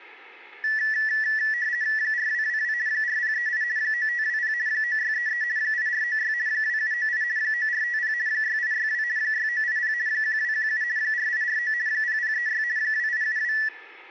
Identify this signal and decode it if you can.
RTTY (50 baud, 170 Hz shift), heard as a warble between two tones, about 1850 Hz centre. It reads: 4222 4038 9520 9633 8496 2798 9450 6862 6980 1217 4849 0036 2872